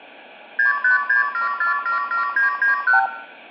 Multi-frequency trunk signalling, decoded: 6567477991

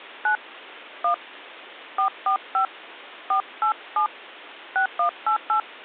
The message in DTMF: 9 1 445 487 6188

